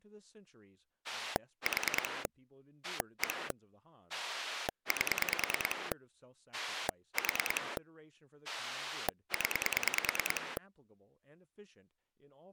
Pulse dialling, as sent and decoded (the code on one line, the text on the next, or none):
4 / 1 / 8 / 4 / 10
4 1 8 4 0